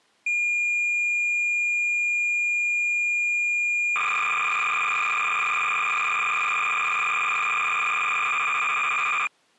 Cassette data (Kansas City type), 300 baud, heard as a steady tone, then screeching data.